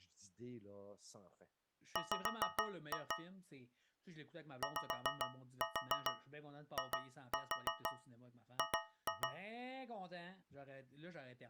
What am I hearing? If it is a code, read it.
Tap code, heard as taps on a metal pipe, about 6 knocks a second, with speech in French. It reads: W YIG